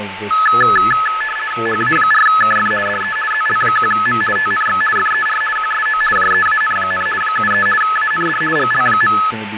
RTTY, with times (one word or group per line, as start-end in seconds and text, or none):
1.7-2.7 HA4KF
2.9-3.2 DE
3.3-4.2 ZL1M
4.4-4.8 TNX
5.0-5.4 FER
5.6-6.0 QSO
6.2-7.1 JEAN,
7.2-7.7 73
7.8-8.4 AND
8.6-9.2 GL.